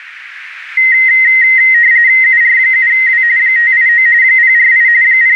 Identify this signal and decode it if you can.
RTTY (45.45 baud, 170 Hz shift), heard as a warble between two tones, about 1950 Hz centre, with radio static. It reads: UR7W 589 048 …